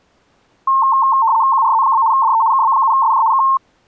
RTTY (75 baud, 170 Hz shift), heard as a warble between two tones, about 990 Hz centre. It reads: QRZ? DE KB7SJ K